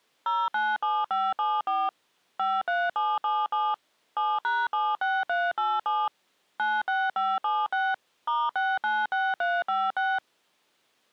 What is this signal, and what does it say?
DTMF, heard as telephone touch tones, dialled by machine, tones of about 220 ms. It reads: 097574 53777 7#76387 96576 *696356